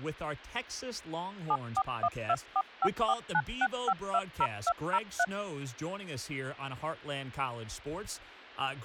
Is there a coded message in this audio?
Yes: DTMF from 1.5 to 5.2 s, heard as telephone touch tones, dialled by machine, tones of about 60 ms, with speech in English. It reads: 741245496520203